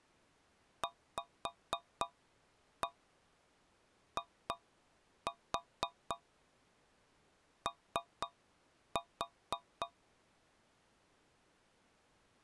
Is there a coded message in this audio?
Yes: tap code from 0.8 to 10.0 s, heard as taps on a metal pipe, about 3 knocks a second. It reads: VIO